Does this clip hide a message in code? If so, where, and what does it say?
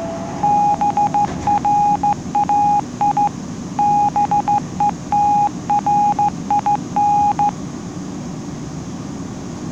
Yes: Morse code (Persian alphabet) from 0.4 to 7.6 s, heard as a keyed tone, hand-sent with a straight key, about 15 wpm, 820 Hz, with the noise inside a subway train. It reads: برای بهترین